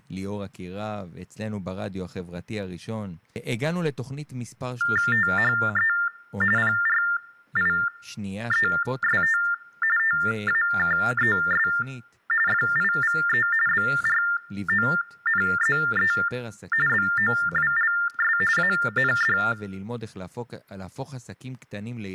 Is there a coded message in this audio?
Yes: TTY/TDD text telephone tones (45.45 baud Baudot) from 4.8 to 19.5 s, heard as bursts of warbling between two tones, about 400 Hz shift, 1600 Hz centre, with speech in Hebrew. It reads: THE PRIEST TAKES FIVE BRONZE BOWLS AND